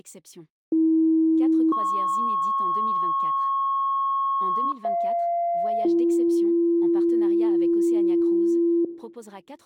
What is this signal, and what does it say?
Two-tone page, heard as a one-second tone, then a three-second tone, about 320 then 1090 Hz, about 690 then 340 Hz, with speech in French.